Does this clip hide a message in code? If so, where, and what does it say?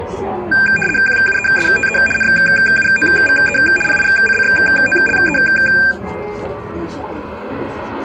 Yes: RTTY (75 baud, 850 Hz shift) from 0.5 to 5.9 s, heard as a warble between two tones, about 2000 Hz centre, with static crashes and the noise of a cafe. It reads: QUESTE NUOVE PICCOLE